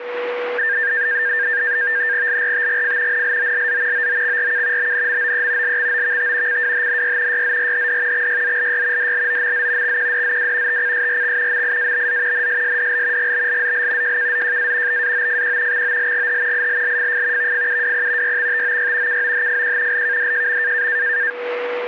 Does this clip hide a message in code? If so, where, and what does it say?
Yes: NAVTEX (SITOR-B), 100 baud, 170 Hz shift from 0.6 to 21.3 s, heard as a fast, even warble, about 1700 Hz centre, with static crashes and a steady whistle near 490 Hz. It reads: LRTGF NLOLZ OOXRK BNMOE LXOVT CWHNY YZRHD XYZLY DLOMZ XQDZW TCSRX MIABZ NSSDL GBLZL JKZJA BAOFQ XOLGH ILLFF VFUWP YXTOY KOHFQ LKDJM